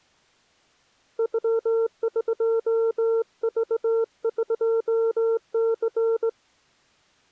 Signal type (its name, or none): Morse code